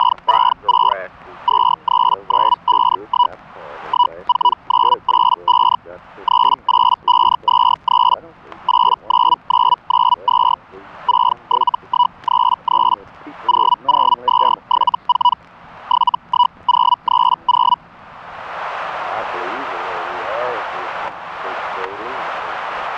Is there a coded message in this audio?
Yes: Hellschreiber (Feld-Hell, 122.5 baud) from 0.0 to 17.8 s, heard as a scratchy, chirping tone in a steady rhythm, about 980 Hz, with static crashes. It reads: … 23951 14985 38523 89992 67133 00274 71030